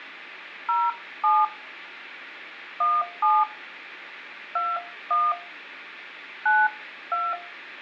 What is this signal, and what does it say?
DTMF, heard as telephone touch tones, dialled by hand, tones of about 220 ms, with room echo. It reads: 07 17 21 92